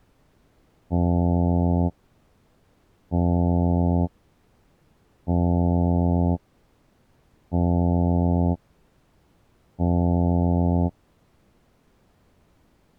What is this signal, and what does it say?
Ship horn signal, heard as a ship's horn, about 90 Hz. 5 short. At sea: I doubt that you are doing enough to avoid a collision.